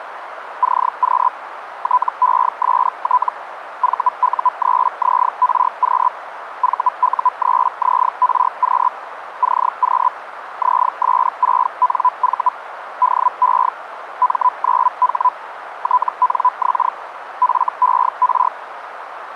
Hellschreiber (Feld-Hell, 122.5 baud), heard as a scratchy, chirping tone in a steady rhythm, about 1000 Hz, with radio static and a narrow filter. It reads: CQ TEST VU3ZRQ VU3ZRQ CQ ZS6NV DE M9H TNX FER